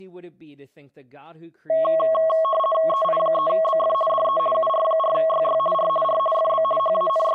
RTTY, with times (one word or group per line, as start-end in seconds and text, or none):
2.9-3.9 EI3BF
4.1-4.4 DE
4.5-5.6 UR4YY
5.7-5.9 R
6.0-6.2 R
6.3-6.6 FB
6.8-7.4 …